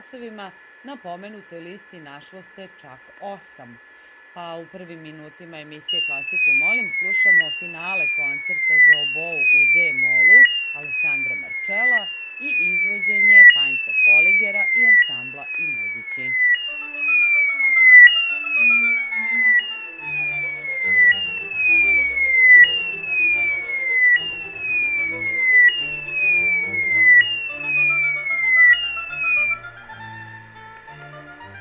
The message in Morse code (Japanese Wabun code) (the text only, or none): none